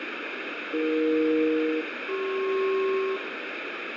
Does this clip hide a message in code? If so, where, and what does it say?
Yes: aircraft SELCAL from 0.7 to 3.2 s, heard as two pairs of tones, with heavy radio static. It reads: AE-CP